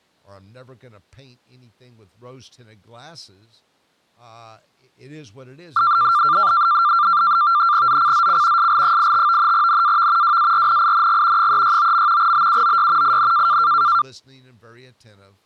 NAVTEX (SITOR-B), 100 baud, 170 Hz shift, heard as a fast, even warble, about 1280 Hz centre, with speech in English. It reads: ZCZC SL85 NAV WARNING 369. BUOY IN